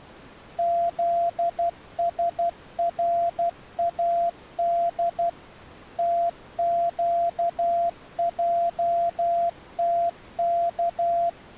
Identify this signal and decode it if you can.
Morse code, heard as a keyed tone, machine-sent, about 12 wpm, 690 Hz. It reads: ZSRAD TQJTK